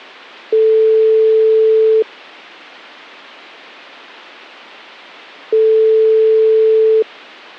Telephone call progress tone (single-tone plan, as in most of Europe), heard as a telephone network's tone, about 440 Hz, 1.5 s on and 3.5 s off. Ringback tone.